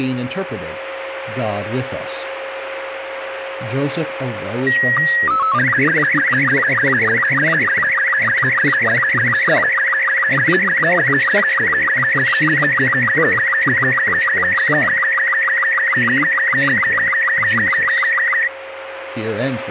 SSTV (slow-scan television), Robot 36, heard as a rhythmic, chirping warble, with radio static, a steady whistle near 540 Hz and speech in English.